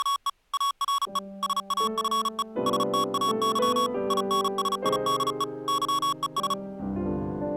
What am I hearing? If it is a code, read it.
Morse code, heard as electronic beeps, machine-sent, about 35 wpm, 1120 Hz. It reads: … ARE SAFE STAY INSIDE YES